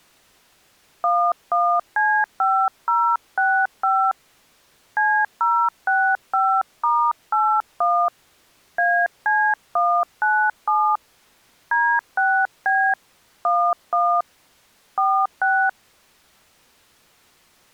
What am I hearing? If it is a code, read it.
DTMF, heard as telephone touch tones, dialled by hand, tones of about 280 ms. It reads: 11C5065 C065*81 AC197 D6B 11 46